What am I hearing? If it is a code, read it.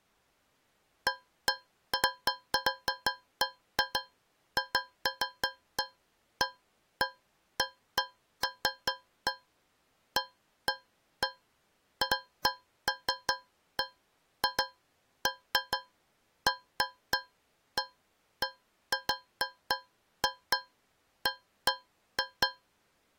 Irregular taps on a metal pipe. There is no code.